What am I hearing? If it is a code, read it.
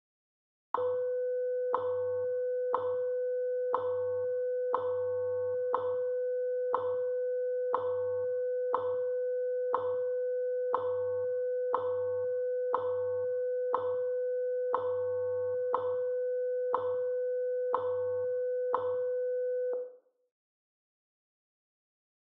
Radio time signal (WWV, Colorado), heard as ticks, one a second, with room echo.